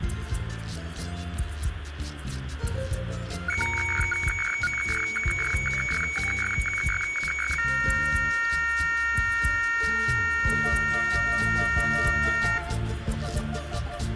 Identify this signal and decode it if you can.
Weather fax (radiofax), 120 lines a minute, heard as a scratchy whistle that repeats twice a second, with radio static and room echo.